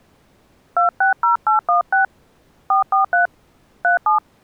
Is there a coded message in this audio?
Yes: DTMF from 0.8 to 4.2 s, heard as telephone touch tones, dialled by hand, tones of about 120 ms. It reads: 260816 443 37